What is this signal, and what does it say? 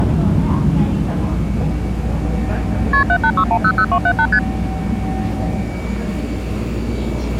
Multi-frequency trunk signalling (R1, as on North American trunks), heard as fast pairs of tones, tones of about 70 ms, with the noise inside a subway train. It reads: KP 786100278 ST